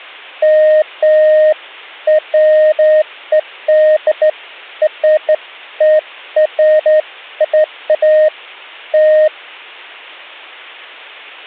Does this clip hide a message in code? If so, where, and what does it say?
No, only beeps of irregular length.